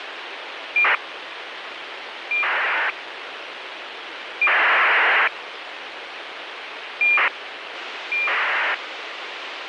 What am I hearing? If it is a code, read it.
ACARS aircraft data, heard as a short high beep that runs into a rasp, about 2400 baud, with radio hiss.